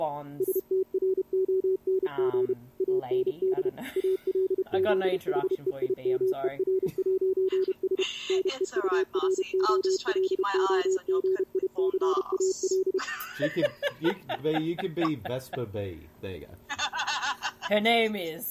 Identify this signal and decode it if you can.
Morse code, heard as a keyed tone, machine-sent, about 31 wpm, 380 Hz. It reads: STRONG AND ALZHEIMER'S NEUROLOGICAL